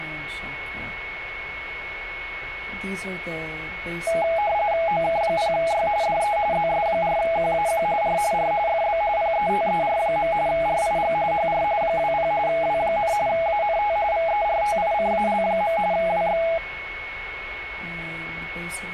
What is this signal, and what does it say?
RTTY (45.45 baud, 170 Hz shift), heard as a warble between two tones, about 750 Hz centre, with radio static and a steady whistle near 2200 Hz. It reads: OK0Y DE ZS4QAQ R R FB PETER. RIG HR 20 W, ANT VERTICAL. WX